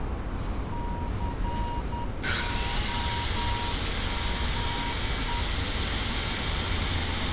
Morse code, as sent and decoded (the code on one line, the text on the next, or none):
-.-. --- -- .
COME